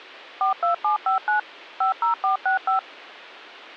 DTMF, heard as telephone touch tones, dialled by machine, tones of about 120 ms. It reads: 42759 50465